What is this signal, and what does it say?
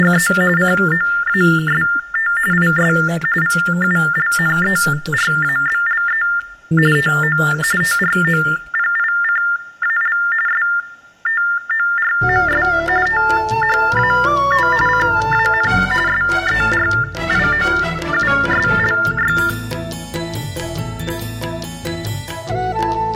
TTY/TDD text telephone tones (45.45 baud Baudot), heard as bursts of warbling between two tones, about 400 Hz shift, 1600 Hz centre. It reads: … COAST IS VULNERABLE TO TROPICAL STORMS THAT CAN SERIOUSLY